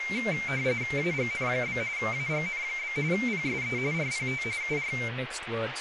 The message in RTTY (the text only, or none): AGN? AGN? PSE RPT UR